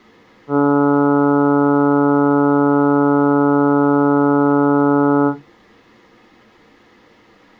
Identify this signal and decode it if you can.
Ship horn signal, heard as a ship's horn, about 140 Hz. 1 long. At sea: a vessel nearing a blind bend, or under power and making way in fog.